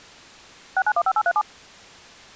DTMF, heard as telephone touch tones, dialled by machine, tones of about 60 ms. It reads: 6915837